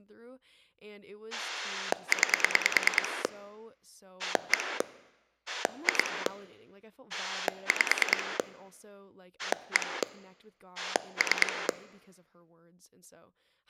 Pulse dialling, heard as a rotary dial, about 9 pulses a second, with speech in English. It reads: 9 1 2 5 1 3